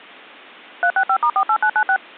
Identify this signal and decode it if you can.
DTMF, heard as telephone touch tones, dialled by machine, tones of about 70 ms. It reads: 365*48996